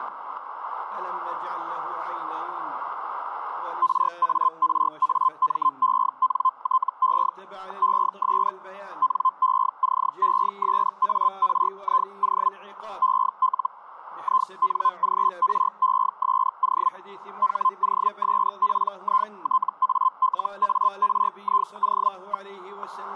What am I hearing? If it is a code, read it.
Hellschreiber (Feld-Hell, 122.5 baud), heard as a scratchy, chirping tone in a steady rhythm, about 1040 Hz, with static crashes. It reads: RARAMENTE ES NECESARIO EL INGRESO HOSPITALARIO.